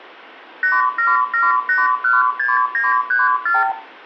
Multi-frequency trunk signalling (R2, with the far end's replies), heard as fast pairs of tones, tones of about 180 ms, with room echo. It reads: 877816934